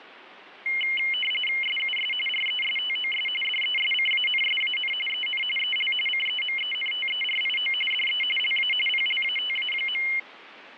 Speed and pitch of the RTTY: 45.45 baud, 850 Hz shift, 2550 Hz centre

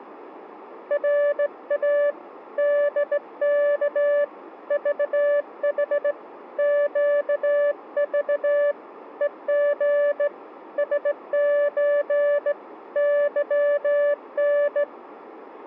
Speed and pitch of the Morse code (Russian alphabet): 17 wpm, 580 Hz

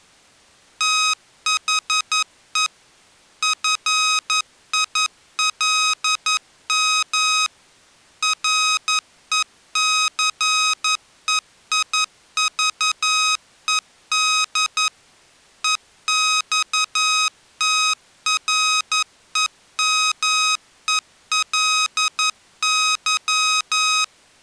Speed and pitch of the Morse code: 11 wpm, 1260 Hz

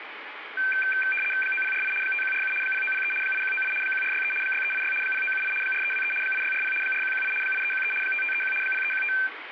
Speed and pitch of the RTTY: 75 baud, 850 Hz shift, 1950 Hz centre

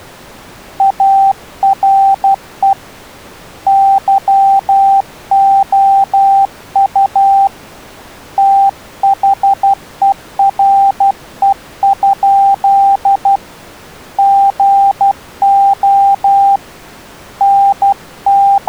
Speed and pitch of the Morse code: 12 wpm, 790 Hz

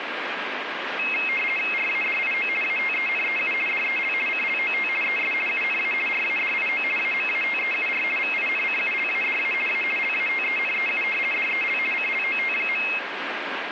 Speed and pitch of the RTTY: 50 baud, 450 Hz shift, 2350 Hz centre

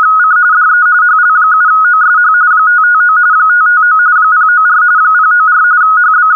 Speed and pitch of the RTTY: 45.45 baud, 170 Hz shift, 1360 Hz centre

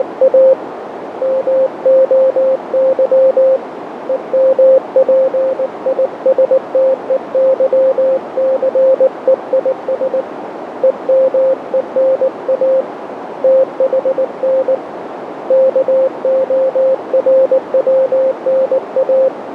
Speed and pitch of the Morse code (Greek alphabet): 19 wpm, 530 Hz

